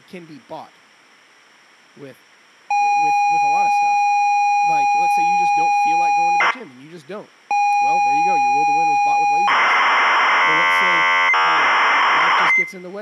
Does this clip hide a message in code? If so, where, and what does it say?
Yes: ZX Spectrum tape loading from 2.7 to 12.6 s, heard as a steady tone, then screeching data, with speech in English.